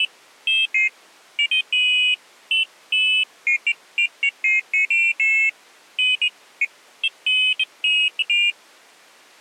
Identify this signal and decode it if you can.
Pairs of high tones at irregular times. There is no code.